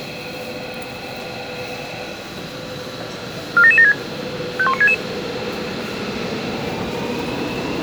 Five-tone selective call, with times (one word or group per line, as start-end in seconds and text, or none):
3.6-3.9 47776
4.6-4.9 51966